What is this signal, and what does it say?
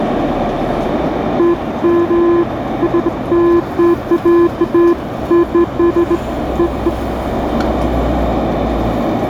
Beeps of irregular length, with radio static, a narrow filter and the noise of a residential street. There is no code.